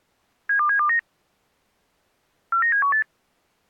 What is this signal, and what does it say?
Five-tone selective call (CCIR), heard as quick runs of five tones, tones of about 100 ms. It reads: 72729 49718